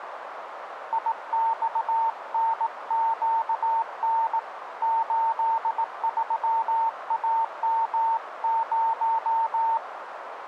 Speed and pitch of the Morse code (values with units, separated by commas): 18 wpm, 910 Hz